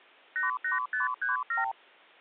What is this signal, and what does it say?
Multi-frequency trunk signalling (R2, with the far end's replies), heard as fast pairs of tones, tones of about 140 ms. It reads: 88537